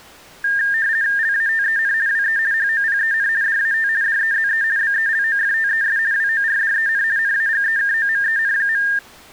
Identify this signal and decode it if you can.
RTTY (50 baud, 170 Hz shift), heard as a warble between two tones, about 1700 Hz centre. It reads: LATEN WE HOPEN DAT DEZE BELOFTES WORDEN NAGEKOMEN.